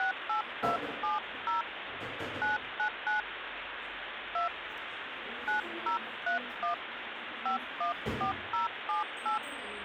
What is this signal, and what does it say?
DTMF, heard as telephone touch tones, dialled by hand, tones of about 120 ms, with phone line noise and the noise of a cafe. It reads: 68270 999 2 9031 514078